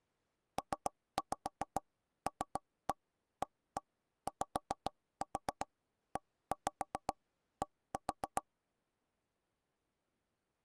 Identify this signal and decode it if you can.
Tap code, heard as knocks on wood, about 7 knocks a second. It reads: PLAYED